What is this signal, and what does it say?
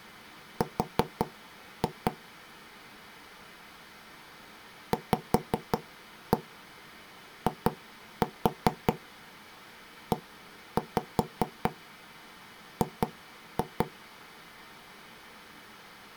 Tap code, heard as knocks on wood, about 5 knocks a second. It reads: R VIEG